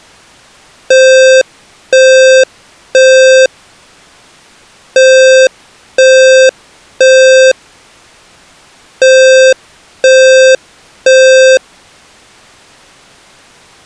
Alarm pattern, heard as an alarm's beeps, played three times, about 520 Hz. Temporal three. Smoke or fire, evacuate.